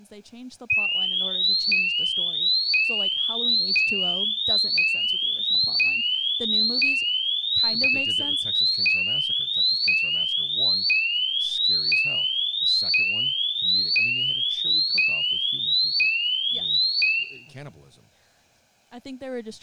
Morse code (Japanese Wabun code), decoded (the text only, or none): none